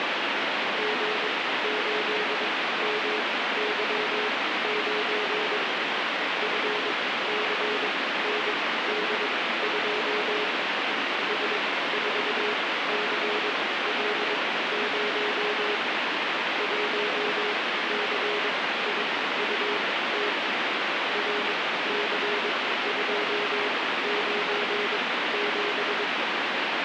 Morse code, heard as a keyed tone, machine-sent, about 22 wpm, spaced as for 15 wpm, 420 Hz, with heavy radio static. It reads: G8MY9 FCND2 S4CL0 1CIUT RC297